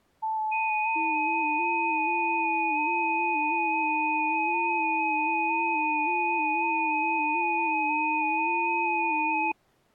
FT8 (several signals at once), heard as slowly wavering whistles, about 6.25 baud.